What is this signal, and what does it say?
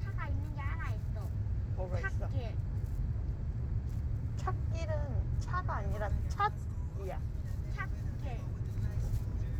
The noise inside a car. There is no code.